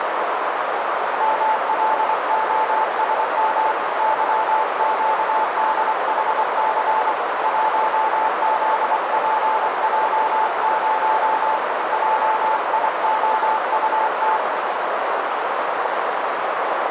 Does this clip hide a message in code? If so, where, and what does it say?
Yes: Morse code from 1.1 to 14.4 s, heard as a keyed tone, hand-sent with a paddle, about 24 wpm, 880 Hz, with heavy radio static and a narrow filter. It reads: MLOSM YQDHC 1ZPJ0 JIOUT